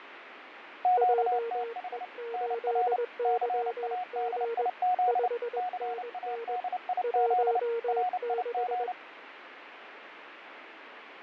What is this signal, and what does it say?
Morse code, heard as two keyed tones, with radio static and fading. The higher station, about 29 wpm, 730 Hz: QTH NR CADIZ CADIZ RIG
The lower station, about 21 wpm, 460 Hz: JE8YG 5NN 16